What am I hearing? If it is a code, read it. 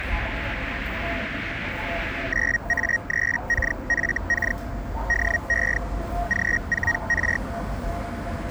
Hellschreiber (Feld-Hell, 122.5 baud), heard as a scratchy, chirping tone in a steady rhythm, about 1900 Hz, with the noise of a residential street. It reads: 9A3KFK DE G4R